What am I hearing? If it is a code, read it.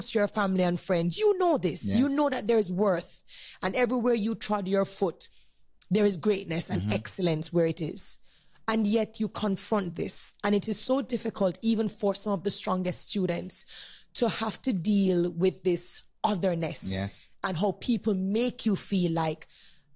Speech in English. There is no code.